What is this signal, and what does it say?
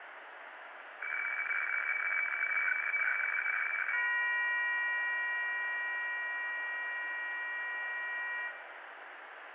Weather fax (radiofax), 120 lines a minute, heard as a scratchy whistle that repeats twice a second, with radio static, fading and room echo.